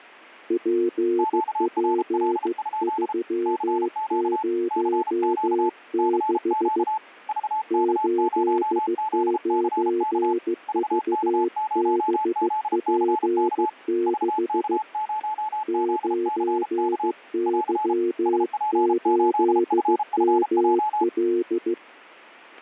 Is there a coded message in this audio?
Yes: Morse code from 0.4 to 21.8 s, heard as two keyed tones, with static crashes. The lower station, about 15 wpm, 350 Hz: PP306 89VBP6 9Y8ML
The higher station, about 33 wpm, 870 Hz: QRL? CQ CQ CQ VK0ZCK VK0ZCK VK0ZCK <AR> SP8FFJ